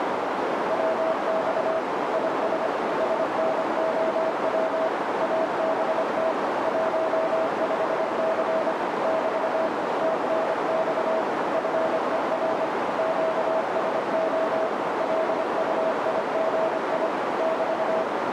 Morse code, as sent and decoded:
.-- -..- / .. ... / ... -. --- .-- / .- -... - / .---- ..... -.-. / -...- / - -. -..- / ..-. . .-. / --.- ... --- / .-.. ..- .. --. .. / -...-
WX IS SNOW ABT 15C <BT> TNX FER QSO LUIGI <BT>

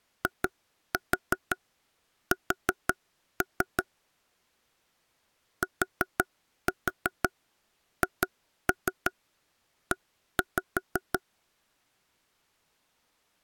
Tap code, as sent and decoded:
2-4 4-3 / 4-4 2-3 1-5
IS THE

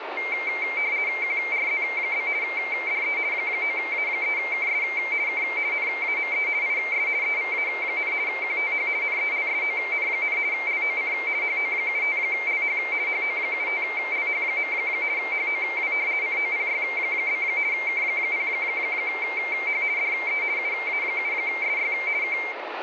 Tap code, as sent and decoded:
none

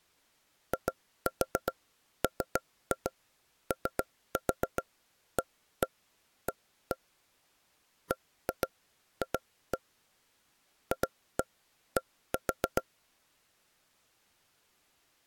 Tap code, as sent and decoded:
2-4 3-2 3-4 1-1 1-1 / 1-2 2-1 / 2-1 1-4
IMOAA BF FD

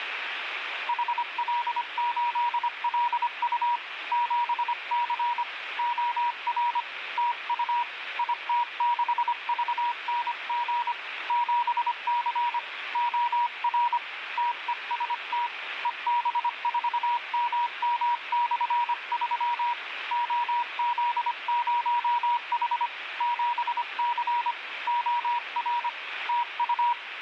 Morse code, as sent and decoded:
.... .-.. ---.. .-.. ..- / --... -.-. / --- .-. / - ..- / .. - -.... ...- -. --. / --... -.-. / --- .-. / - . ... - / . -... ....- -- -- -..-. ...-- / --- --.. ----- .... / --... -.-. / --- .-. / - ..-
HL8LU 7C OR TU IT6VNG 7C OR TEST EB4MM/3 OZ0H 7C OR TU

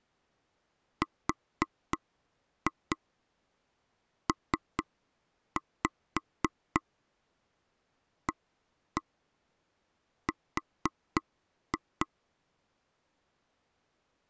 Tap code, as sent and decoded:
4-2 3-5 1-1 4-2
RPAR

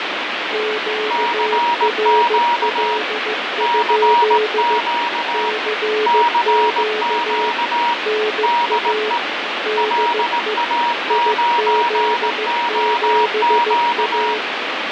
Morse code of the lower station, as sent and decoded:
--.- .-. .-.. ..--.. / -.-. --.- / -. .- / -.. . / .. --.. --... .-
QRL? CQ NA DE IZ7A

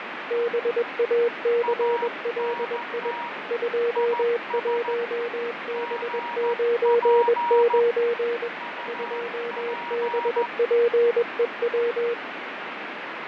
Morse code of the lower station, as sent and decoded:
-... .- -.-. .-.. .. / ..--- .---- -... ----. ----. / ..--- -... .--. . .--
BACLI 21B99 2BPEW

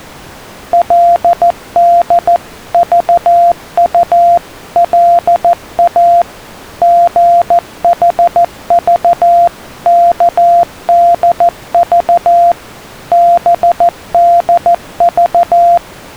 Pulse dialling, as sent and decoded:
none

